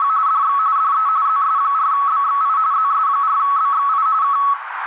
RTTY (45.45 baud, 170 Hz shift), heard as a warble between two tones, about 1210 Hz centre, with radio static and a narrow filter. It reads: … DX DE ZS4BXI ZS4BXI K